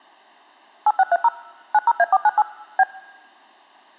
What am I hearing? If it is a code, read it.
DTMF, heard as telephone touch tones, dialled by machine, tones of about 40 ms. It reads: 8630 90A498 B